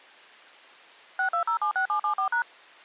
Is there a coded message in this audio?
Yes: DTMF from 1.2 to 2.4 s, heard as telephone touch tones, dialled by machine, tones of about 100 ms. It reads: 62076774#